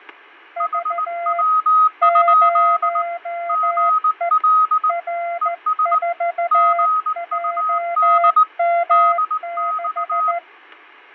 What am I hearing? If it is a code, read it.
Morse code, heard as two keyed tones, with fading. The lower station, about 14 wpm, 690 Hz: V 0E R4JM6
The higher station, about 19 wpm, 1260 Hz: HW? GL ES GUD DX